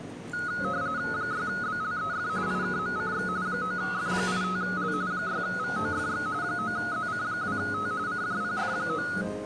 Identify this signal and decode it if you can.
RTTY (45.45 baud, 170 Hz shift), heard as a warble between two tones, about 1360 Hz centre, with the noise of a cafe. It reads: 6BLEF IKMCX 9F85L 6VOFX 9ZC2T CJPF9